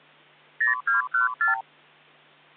Multi-frequency trunk signalling (R2, with the far end's replies), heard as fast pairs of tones, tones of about 130 ms. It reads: 0214